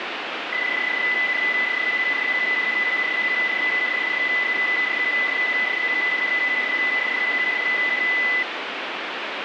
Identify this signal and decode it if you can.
PSK31 (31.25 baud), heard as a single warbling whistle, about 2000 Hz, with radio static.